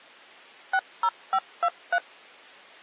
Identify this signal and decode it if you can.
DTMF, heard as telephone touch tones, dialled by machine, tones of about 60 ms. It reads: 60523